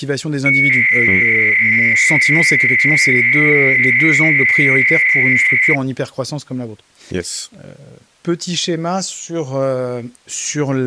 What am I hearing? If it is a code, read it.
300-baud modem data (Bell 103 tones), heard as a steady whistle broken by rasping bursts, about 300 baud, 200 Hz shift, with speech in French.